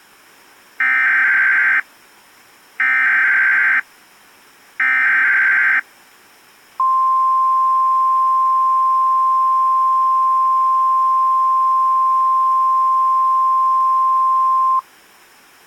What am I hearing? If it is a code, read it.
Emergency Alert System (SAME) tones (header bursts, then the 1050 Hz attention tone), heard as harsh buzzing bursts, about 520.83 baud.